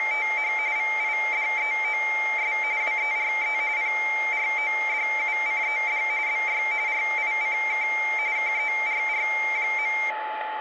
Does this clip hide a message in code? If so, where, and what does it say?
Yes: RTTY (45.45 baud, 170 Hz shift) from 0.0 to 10.1 s, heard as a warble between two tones, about 2200 Hz centre, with radio static and a steady whistle near 860 Hz. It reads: … VIDEOS WERE PRODUCED BY RICK KERR.